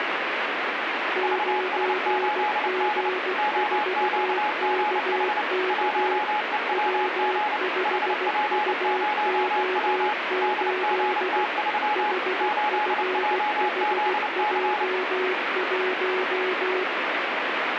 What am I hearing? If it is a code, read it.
Morse code, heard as two keyed tones, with radio static. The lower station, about 16 wpm, 370 Hz: 9G4KK W5UO8 HFHJ1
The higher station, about 29 wpm, 840 Hz: VS8D OQGH 1EWG HP0W DGT3 8JZC